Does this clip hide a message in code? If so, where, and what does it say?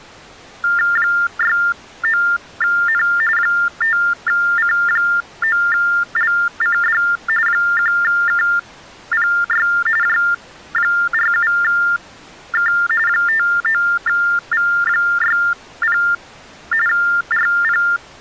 Yes: TTY/TDD text telephone tones (45.45 baud Baudot) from 0.6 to 18.0 s, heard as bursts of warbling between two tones, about 400 Hz shift, 1600 Hz centre. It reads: 69N 5C9LCD 1KPY J47K 59V60 RP